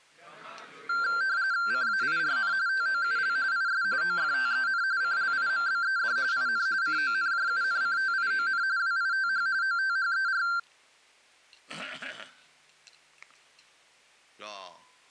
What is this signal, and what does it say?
RTTY (45.45 baud, 170 Hz shift), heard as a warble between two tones, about 1470 Hz centre. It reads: CAIRN TOUL IS OFTEN CLIMBED IN CONJUNCTION WITH OTHER